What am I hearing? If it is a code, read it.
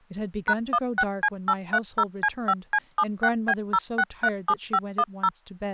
DTMF, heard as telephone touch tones, dialled by machine, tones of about 60 ms, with speech in English. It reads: #16C830C5C76B0637510